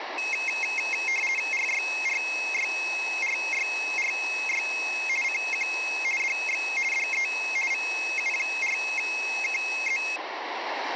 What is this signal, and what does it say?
RTTY (50 baud, 450 Hz shift), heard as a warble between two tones, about 2350 Hz centre, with radio static. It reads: RYRYRYRY CQ DX DE VU4KZ